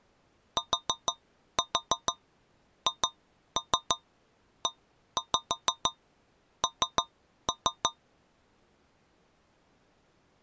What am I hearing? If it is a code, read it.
Tap code, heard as taps on a metal pipe, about 6 knocks a second. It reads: THEN